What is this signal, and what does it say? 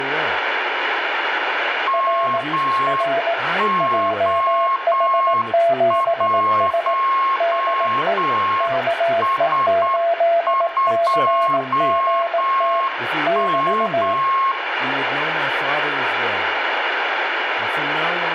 Morse code, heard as two keyed tones, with radio static and room echo. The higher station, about 8 wpm, 1080 Hz: MO1S2M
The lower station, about 18 wpm, 680 Hz: R R JH7S DE KE8CGT <BT>